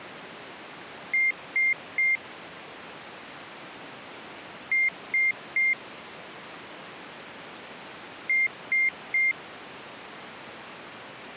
Beep code, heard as a piezo beeper, played three times, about 2100 Hz. 3 short. In AMI BIOS tables: failure in the first 64 KB of memory; in Dell tables: chipset error.